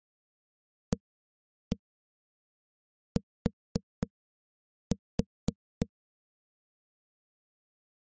Tap code, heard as knocks on a wall, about 3 knocks a second. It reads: AT